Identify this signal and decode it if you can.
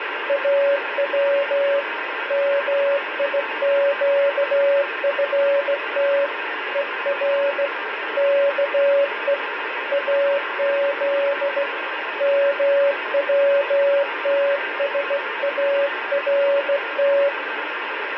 Morse code (Persian alphabet), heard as a keyed tone, hand-sent with a straight key, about 16 wpm, 560 Hz, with radio static. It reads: او میگفت هر که از موتسارت